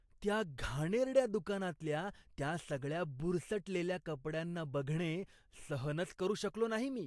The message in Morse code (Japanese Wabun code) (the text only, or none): none